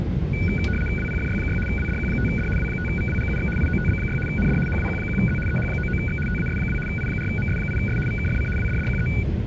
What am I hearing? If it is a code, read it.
RTTY (75 baud, 850 Hz shift), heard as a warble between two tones, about 1900 Hz centre, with static crashes and the noise inside a subway train. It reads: WPFY6 WDQ5D W5VWGUX IOTB6 ND HWQ1Z EH99X TAS2 I4MS8S VKFC WDDQE